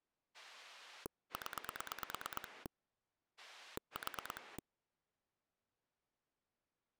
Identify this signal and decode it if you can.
Pulse dialling, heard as a rotary dial, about 9 pulses a second. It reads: 0 4